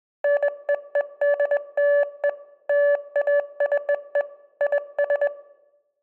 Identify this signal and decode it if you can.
Morse code (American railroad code), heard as a keyed tone, machine-sent, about 580 Hz, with room echo. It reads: NEEDLE LACE IS